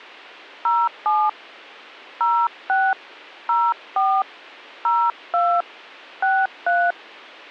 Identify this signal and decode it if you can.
DTMF, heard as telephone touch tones, dialled by hand, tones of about 240 ms. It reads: 07 06 04 02 63